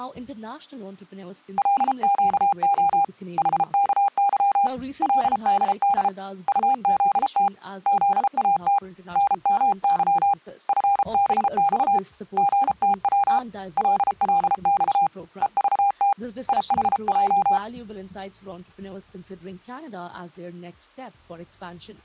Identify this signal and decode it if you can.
Morse code, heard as a keyed tone, hand-sent with a paddle, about 33 wpm, 800 Hz. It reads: LQO HKY LDD UZT ZAT NMY FBX GTW LLX EVT IHJ